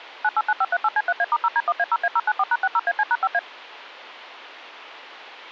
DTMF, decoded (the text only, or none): 989538C3A*0D1A0A094#60AC#5A